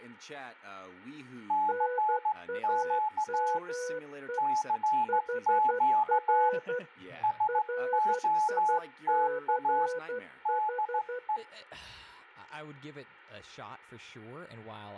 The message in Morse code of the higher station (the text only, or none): CQ CQ SOTA DE